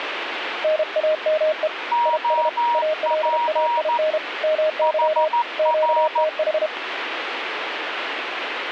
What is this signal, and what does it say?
Morse code, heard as two keyed tones, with radio static. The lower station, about 32 wpm, 620 Hz: NAME IS ALAIN MY QTH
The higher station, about 14 wpm, 950 Hz: OP HR